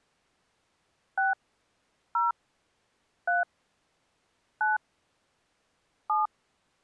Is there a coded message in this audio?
Yes: DTMF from 1.2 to 6.3 s, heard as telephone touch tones, dialled by hand, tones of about 160 ms. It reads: 6 0 3 9 7